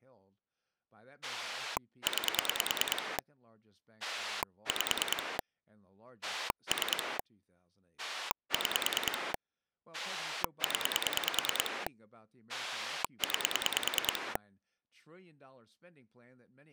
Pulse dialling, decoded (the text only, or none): 9 5 3 6 0 9